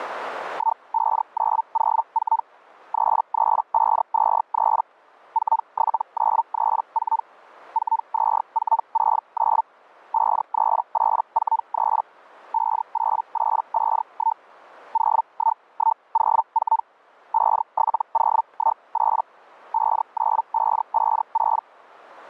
Hellschreiber (Feld-Hell, 122.5 baud), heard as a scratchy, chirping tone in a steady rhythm, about 900 Hz. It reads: 15904 33523 47934 42469 53843 58851 01104 57018 59556